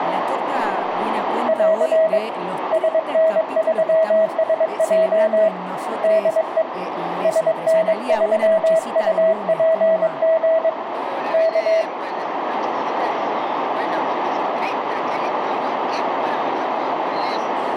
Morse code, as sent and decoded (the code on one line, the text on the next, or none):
.-.-. / ... -. ...-- ... .--- / -.. . / ... -. ...-- ..- .--. --. / -.-
<AR> SN3SJ DE SN3UPG K